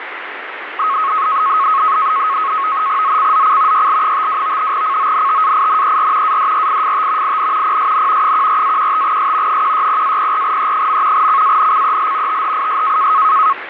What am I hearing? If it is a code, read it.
NAVTEX (SITOR-B), 100 baud, 170 Hz shift, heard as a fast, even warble, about 1180 Hz centre, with radio static. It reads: ZCZC YL52 CONTAINER ADRIFT IN PSN 14-15S 160-04E. CANCEL THIS